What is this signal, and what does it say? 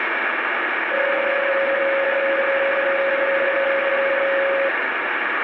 PSK31 (31.25 baud), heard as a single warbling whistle, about 550 Hz, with radio static.